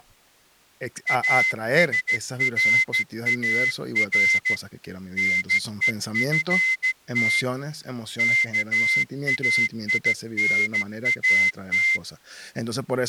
Morse code (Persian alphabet), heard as a whistle, hand-sent with a straight key, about 14 wpm, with speech in Spanish. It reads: اسرار نهفت کاینات